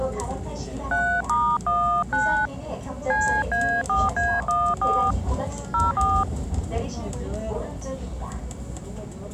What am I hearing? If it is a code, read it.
DTMF, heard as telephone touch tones, dialled by hand, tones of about 260 ms, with the noise inside a subway train. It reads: 3*19 CA4A14 04